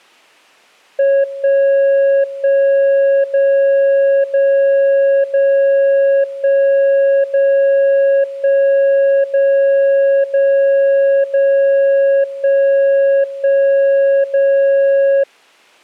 Radio time signal (DCF77), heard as a tone whose level steps once a second, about 550 Hz. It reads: 1 1 0 0 0 1 0 1 0 0 0 1 1 0